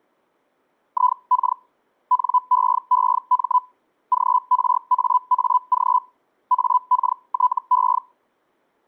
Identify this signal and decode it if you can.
Hellschreiber (Feld-Hell, 122.5 baud), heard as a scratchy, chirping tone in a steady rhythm, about 1000 Hz. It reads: IK NEEM GRAAG AKTE